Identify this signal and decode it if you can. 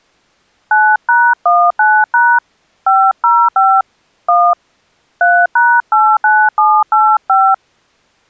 DTMF, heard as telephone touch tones, dialled by hand, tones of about 250 ms. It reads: 9#19# 505 1 3#89785